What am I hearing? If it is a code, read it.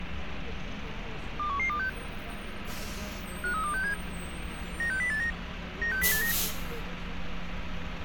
Five-tone selective call (CCIR), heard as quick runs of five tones, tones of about 100 ms, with radio hiss and street noise. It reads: 21126 53267 96089 96089